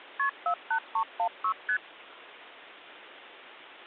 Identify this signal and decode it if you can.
Multi-frequency trunk signalling (R1, as on North American trunks), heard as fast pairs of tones, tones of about 80 ms. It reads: KP 48316 ST